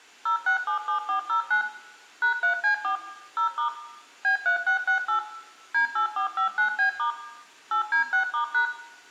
DTMF, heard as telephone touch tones, dialled by machine, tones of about 110 ms, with room echo. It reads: 0677409 #3C4 0* B3668 D8459B* 8D6*#